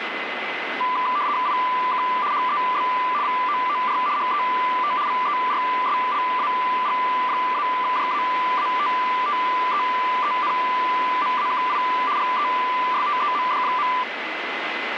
RTTY (75 baud, 170 Hz shift), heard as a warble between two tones, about 1090 Hz centre, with radio static and a steady whistle near 2030 Hz. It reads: IK HEB VOOR HET VERSLAG-JAATTEENMAKI GESTEMD.